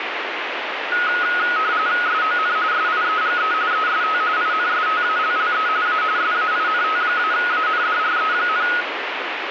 RTTY (45.45 baud, 170 Hz shift), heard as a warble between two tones, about 1360 Hz centre, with radio static. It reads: SON SIEGE EST INSTALLE A SAINT-ANDRE,